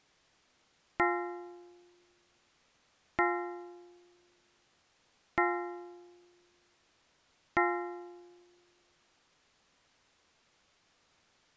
Clock strike, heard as a bell. 4. Four o'clock.